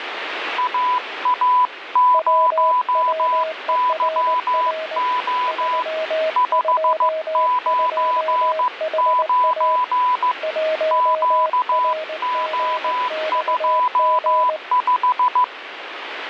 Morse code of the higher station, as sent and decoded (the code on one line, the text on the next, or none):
.- .- ----- -.-- --- / ..... ----. ----. / --.- --- ..--- .....
AA0YO 599 QO25